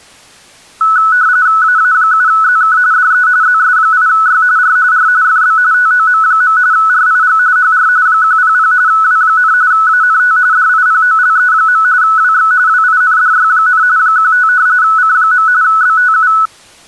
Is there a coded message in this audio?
Yes: RTTY (45.45 baud, 170 Hz shift) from 0.8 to 16.5 s, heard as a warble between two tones, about 1390 Hz centre. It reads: AA7ZK DE ZS8Y R R FB TOM. RIG HR 100 W, ANT DIPOLE. WX WINDY, 15 C. BTU